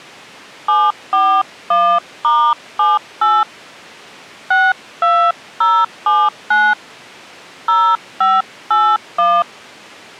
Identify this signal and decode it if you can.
DTMF, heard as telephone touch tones, dialled by hand, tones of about 230 ms. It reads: 741*78 62079 0581